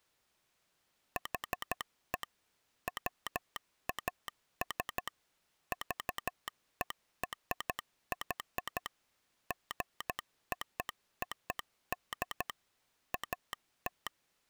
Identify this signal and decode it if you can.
Morse code (American railroad code), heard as a telegraph sounder, machine-sent. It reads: HE WAS VERY GOOD AT